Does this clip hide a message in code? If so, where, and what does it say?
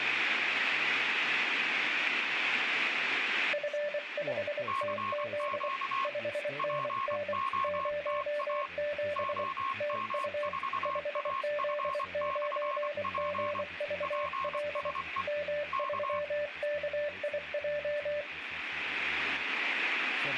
Yes: Morse code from 3.5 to 18.3 s, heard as two keyed tones, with speech in English. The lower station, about 24 wpm, 590 Hz: F5TZ 5NN 07 TU 5Z9GVL M3KIJ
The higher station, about 24 wpm, 1080 Hz: CQ POTA OM4AF/P PSE K